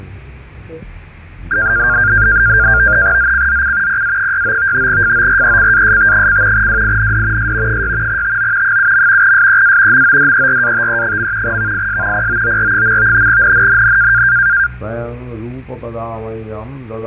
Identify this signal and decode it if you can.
NAVTEX (SITOR-B), 100 baud, 170 Hz shift, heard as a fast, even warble, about 1500 Hz centre, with fading. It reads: ZCZC PA69 FORECAST: WIND S 6 TO 7. SEA MODERATE. VIS POOR. NNNN